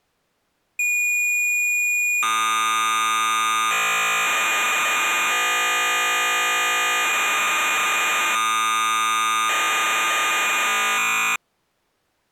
Cassette data (Kansas City type), 1200 baud, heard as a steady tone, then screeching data.